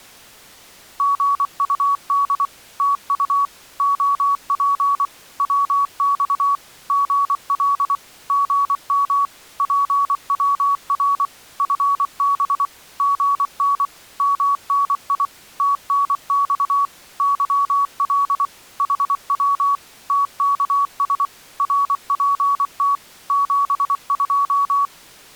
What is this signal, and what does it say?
Morse code, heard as a keyed tone, machine-sent, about 24 wpm, 1130 Hz. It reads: GUD TU OP WX GL GM PWR FB GN MNI TNX YL HW TKS RPT 72